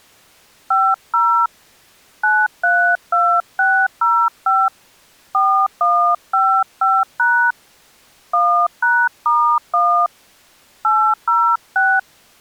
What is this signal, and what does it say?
DTMF, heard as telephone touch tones, dialled by hand, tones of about 290 ms. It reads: 50 932605 4155# 1#*1 806